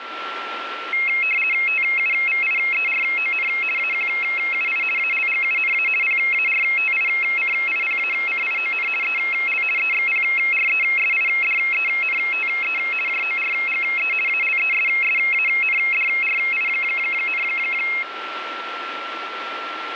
RTTY (50 baud, 450 Hz shift), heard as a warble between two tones, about 2350 Hz centre, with radio static and a steady whistle near 1350 Hz. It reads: TUVIERON AQUI ALGUNA PARTICIPACION EL EXPRESIDENTE JORGE ALESSANDRI,